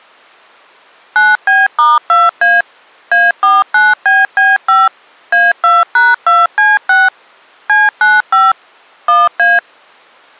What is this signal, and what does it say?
DTMF, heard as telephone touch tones, dialled by machine, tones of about 190 ms. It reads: 9B*2A A49BB5 A2#2C6 C95 1A